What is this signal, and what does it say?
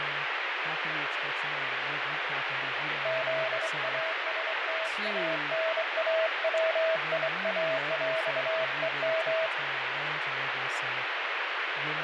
Morse code (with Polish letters), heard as a keyed tone, hand-sent with a straight key, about 24 wpm, 650 Hz, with heavy radio static, fading and speech in English. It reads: ZASTANAWIAŁEM